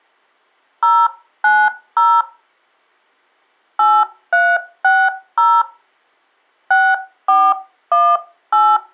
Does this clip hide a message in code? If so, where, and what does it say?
Yes: DTMF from 0.8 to 8.8 s, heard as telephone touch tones, dialled by hand, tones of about 240 ms. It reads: 090 8360 6418